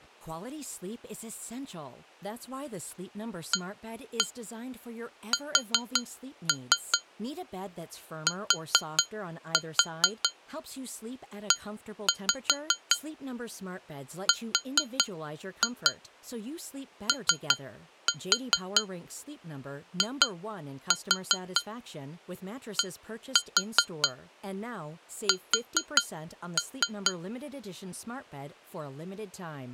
Tap code, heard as taps on glass, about 4 knocks a second, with speech in English. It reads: ASTEROIDS